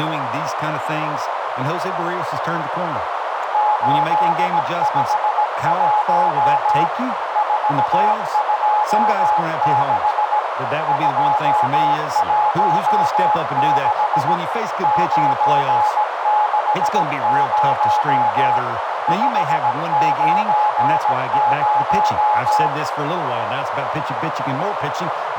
Morse code, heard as a keyed tone, machine-sent, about 17 wpm, 840 Hz, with heavy radio static, a narrow filter and speech in English. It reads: 851 426 216 960 590